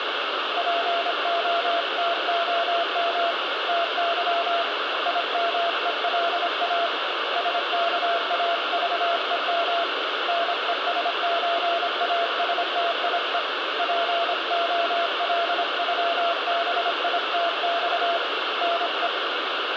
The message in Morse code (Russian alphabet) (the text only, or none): ПОТОМ ТЫ ИМЕЛА СКАЖЕМ НЕСЧАСТИЕ ПОЛЮБИТЬ НЕ